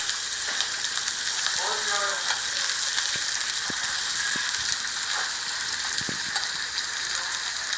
The noise of a restaurant. There is no code.